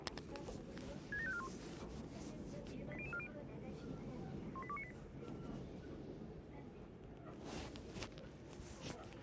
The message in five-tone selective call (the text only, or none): 67541 80040 18298